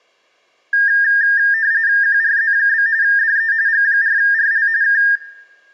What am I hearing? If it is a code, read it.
RTTY (45.45 baud, 170 Hz shift), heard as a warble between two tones, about 1700 Hz centre, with room echo. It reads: QRZ? DE G4RL K